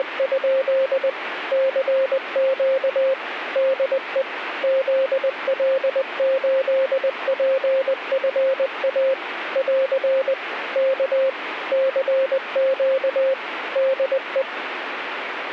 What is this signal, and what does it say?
Morse code, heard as a keyed tone, machine-sent, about 20 wpm, 530 Hz, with radio static. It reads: … CQ DE ZL8PFA <AR> K CQ DE